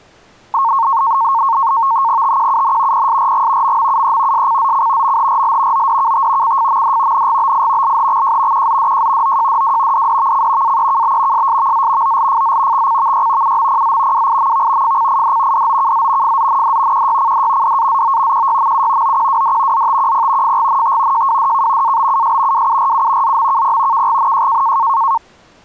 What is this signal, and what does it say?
NAVTEX (SITOR-B), 100 baud, 170 Hz shift, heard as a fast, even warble, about 1000 Hz centre. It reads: TQUN PSRG MMUE SCZC MHRL ODKT CFMD NGBI LHXJ QZDJ OJDW DDVC AEKB SSVZ OLFZ XCVY UMPZ WIMV FCID DOKZ FZND QYCD DAZO QYMU OQWD ZTQP FGNT JWDK ABUS WURU ZMKP KGNJ